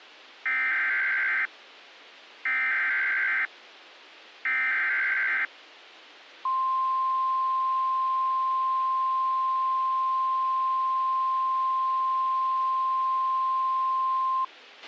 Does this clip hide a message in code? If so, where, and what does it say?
Yes: Emergency Alert System (SAME) tones (header bursts, then the 1050 Hz attention tone) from 0.5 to 14.4 s, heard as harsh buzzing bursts, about 520.83 baud, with a squelch burst at the end.